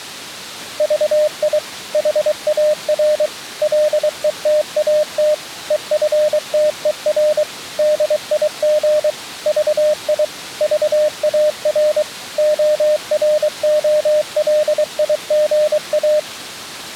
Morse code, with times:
0.8-1.6 VI
1.9-3.3 HAR
3.6-5.3 LETAT
5.7-7.4 EFTER
7.8-9.1 DIG
9.5-10.2 VI
10.6-12.0 VAR
12.4-16.2 OROLIGA

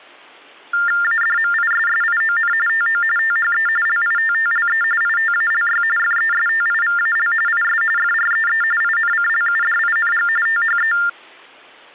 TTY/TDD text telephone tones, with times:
1.0-2.5 ADMISSION
2.7-3.0 TO
3.2-3.7 THE
3.9-4.8 LITTLE
5.0-5.8 ITALY
6.0-7.3 FESTIVAL
7.5-7.8 IS
8.0-8.6 FREE
8.8-10.3 INCLUDING
10.5-10.9 THE

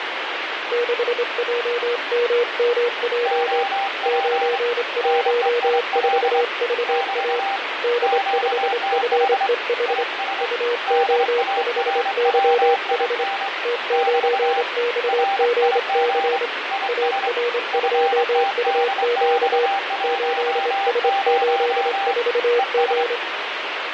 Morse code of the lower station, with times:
0.7-3.6 6JMMJ
4.1-7.4 914VA
7.8-10.0 D5FEH
10.4-13.2 UO5YH
13.6-16.5 T9XGC
16.9-19.7 AR2UQ
20.0-23.2 8S84G

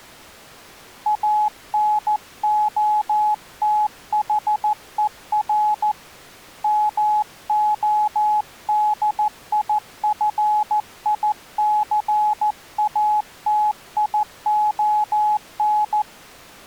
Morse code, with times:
1.1-5.9 ANOTHER
6.6-16.0 MODIFICATION

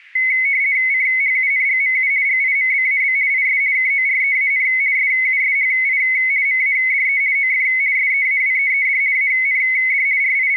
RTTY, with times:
0.9-2.1 CHUNGMU
2.3-3.2 GIMBAB
3.3-3.6 IS
3.8-4.7 KOREAN
5.0-6.0 SUSHI
6.5-7.2 MADE
7.4-7.7 OF
8.0-9.0 SEAWEED
9.2-10.1 AND
10.2-10.6 …

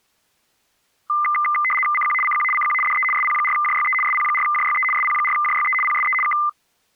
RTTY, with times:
1.9-2.1 CQ
2.2-2.4 CQ
2.5-2.7 CQ
2.8-3.0 DE
3.1-3.9 SP4JYE
4.0-4.8 SP4JYE
4.9-5.7 SP4JYE
5.8-6.1 PSE
6.2-6.3 K

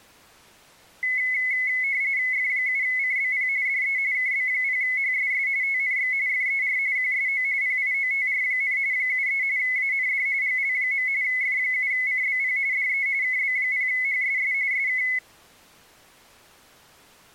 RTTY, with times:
2.3-3.5 F7CBP
3.7-4.0 DE
4.1-5.5 KB0HSS
5.6-6.1 TNX
6.3-6.8 FER
7.0-7.4 QSO
7.6-8.8 PIOTR,
8.9-9.4 73
9.6-10.3 AND
10.4-11.1 GL.
11.2-12.6 F7CBP
12.7-13.1 DE
13.2-14.5 KB0HSS
14.7-15.0 SK

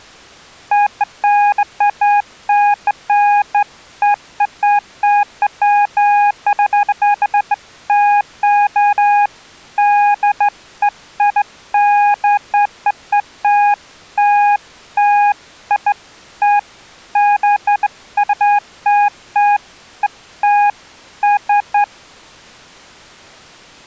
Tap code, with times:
none

